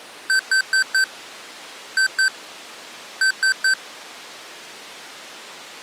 Beep code, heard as beeps from a small speaker, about 1550 Hz. 4-2-3. In Phoenix BIOS tables: gate A20 failure.